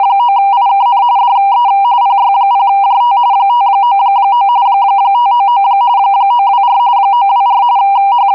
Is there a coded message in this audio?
Yes: RTTY (45.45 baud, 170 Hz shift) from 0.0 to 8.3 s, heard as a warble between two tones, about 880 Hz centre. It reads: … DE PY0JT 599 599 924 924 …